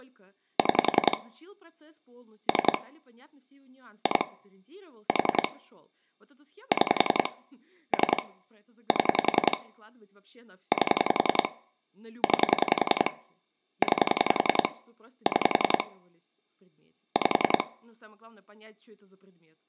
Pulse dialling, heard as clicks on a phone line, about 10 pulses a second, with room echo and speech in Russian. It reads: 6 3 2 4 6 3 7 8 9 9 6 5